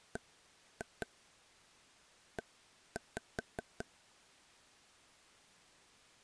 Tap code, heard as taps on a table, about 5 knocks a second. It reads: BE